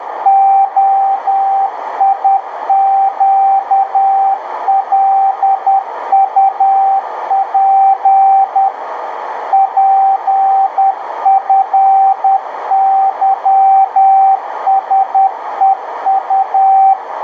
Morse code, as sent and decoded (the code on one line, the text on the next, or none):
--- .. --.- .-.. ..- .--. / .--. ..-. -.-- ... . ..-
OIQLUP PFYSEU